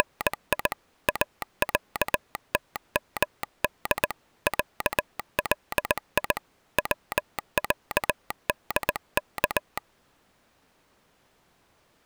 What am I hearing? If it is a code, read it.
Morse code (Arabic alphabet), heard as a telegraph sounder, hand-sent with a paddle, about 19 wpm. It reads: … اعتمد علي وعدك